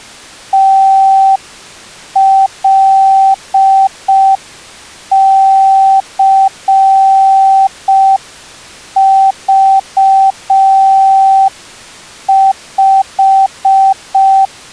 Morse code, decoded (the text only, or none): TLCV5